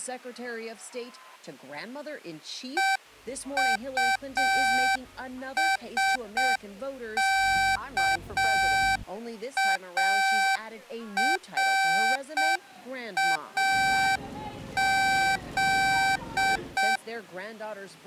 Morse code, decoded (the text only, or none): EUSKARAZ